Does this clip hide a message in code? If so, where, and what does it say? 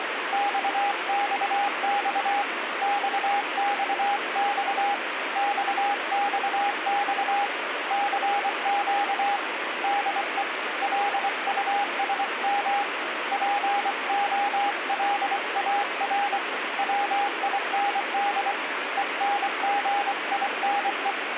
Yes: Morse code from 0.3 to 21.2 s, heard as a keyed tone, hand-sent with a paddle, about 24 wpm, 810 Hz, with radio static. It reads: XXX XXX XXX CQ DE LUSM POLAR WIND ENGINE